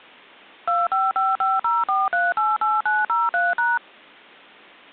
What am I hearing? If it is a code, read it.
DTMF, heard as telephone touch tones, dialled by machine, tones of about 190 ms. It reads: 255504388903#